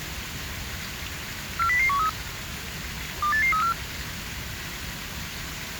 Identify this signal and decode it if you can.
Five-tone selective call (CCIR), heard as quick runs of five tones, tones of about 100 ms, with the noise of a park. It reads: 40013 28834